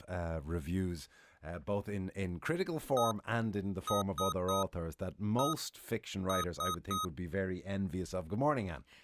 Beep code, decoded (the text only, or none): 1-3-1-3